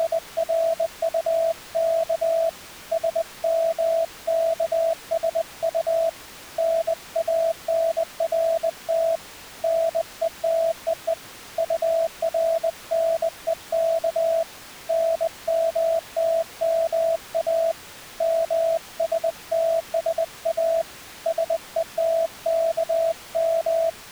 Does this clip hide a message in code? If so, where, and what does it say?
Yes: Morse code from 0.0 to 24.0 s, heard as a keyed tone, hand-sent with a bug key, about 20 wpm, 660 Hz. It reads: … SMKSU NANRT NETEE URNEK NMTMA MSTSA SETKM